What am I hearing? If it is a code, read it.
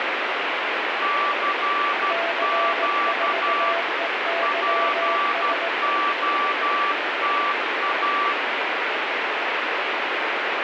Morse code, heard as two keyed tones, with heavy radio static. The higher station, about 12 wpm, 1160 Hz: CQ POTA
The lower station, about 18 wpm, 670 Hz: C4EYS